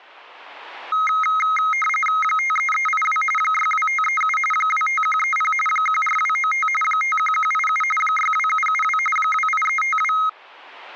RTTY (45.45 baud, 850 Hz shift), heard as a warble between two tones, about 1700 Hz centre. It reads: 53382 62537 25130 14295 51187 62772 28352